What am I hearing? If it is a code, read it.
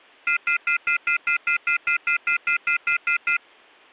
Telephone call progress tone (North American plan), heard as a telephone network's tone, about 1400, 2050, 2450, 2600 Hz, 0.1 s on and 0.1 s off. Off-hook warning tone.